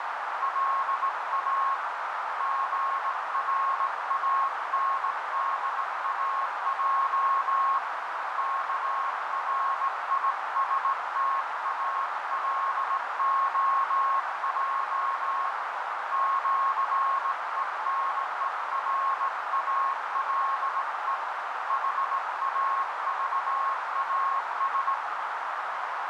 Morse code (with Esperanto letters), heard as a keyed tone, hand-sent with a straight key, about 18 wpm, 1090 Hz, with heavy radio static and a narrow filter. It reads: LA GRANDAJ KRISTALOJ ĜENERALE HAVAS